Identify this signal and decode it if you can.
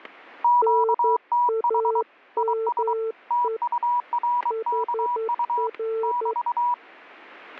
Morse code, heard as two keyed tones, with static crashes. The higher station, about 23 wpm, 970 Hz: QTH IS TURKU <BT>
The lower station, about 11 wpm, 450 Hz: NAME HR